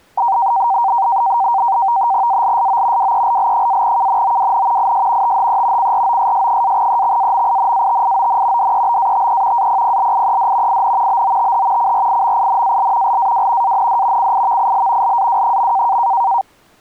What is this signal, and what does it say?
NAVTEX (SITOR-B), 100 baud, 170 Hz shift, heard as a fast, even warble, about 860 Hz centre. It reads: ALSO WELL-KNOWN IS THE CROSS-EXAMINATION DEBATE APPLIED IN BOTH CRIMINAL LAW AND CIVIL LAW.